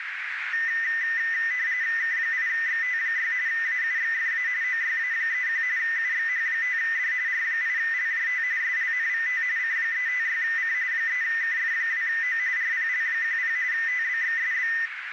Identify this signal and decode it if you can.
RTTY (45.45 baud, 170 Hz shift), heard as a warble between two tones, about 1900 Hz centre, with radio static and a narrow filter. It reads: K8XT6 AUXFA OYA31 UXH5D R8LJT SLNVT C356C 3KF2O RPL10 TBXSB